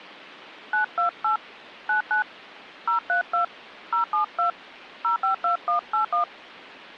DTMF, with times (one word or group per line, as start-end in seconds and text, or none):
0.7-1.4 928
1.9-2.2 99
2.9-3.4 032
3.9-4.5 072
5.0-6.2 052181